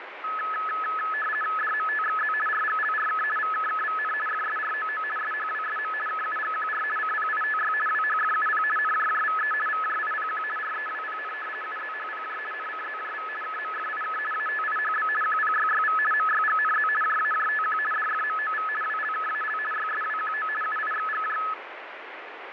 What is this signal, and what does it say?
RTTY (50 baud, 450 Hz shift), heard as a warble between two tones, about 1500 Hz centre, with radio static and fading. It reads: DMTXZ RGLRK VKKVN FSROO SHWSM KUGQR CPITY WHFUP NJJVE VJIPQ REWPN UZHPJ NCZJV KMFIK ATIHB QPYYV MYGNZ JAJTQ DFMOV WLKAL YSWQO UIXGJ